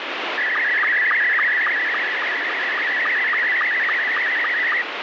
SSTV (slow-scan television), Scottie S2, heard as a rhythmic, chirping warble, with heavy radio static.